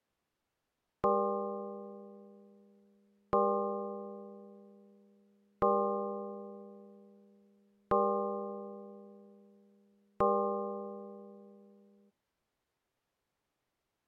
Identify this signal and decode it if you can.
Clock strike, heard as a bell. 5. Five o'clock.